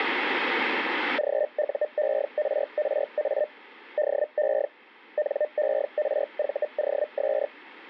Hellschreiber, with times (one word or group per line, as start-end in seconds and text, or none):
1.2-3.5 GUERRA
4.0-4.7 DE
5.2-7.5 NERVOS